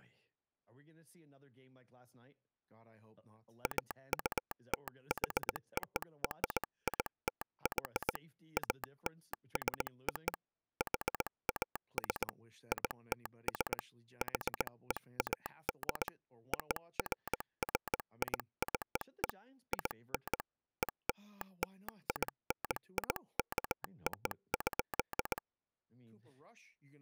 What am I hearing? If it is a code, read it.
Morse code (American railroad code), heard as a telegraph sounder, hand-sent with a straight key, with speech in English. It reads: AUTHORITY ALSO HAS ITS HEAD OFFICE IN ELLINIKO.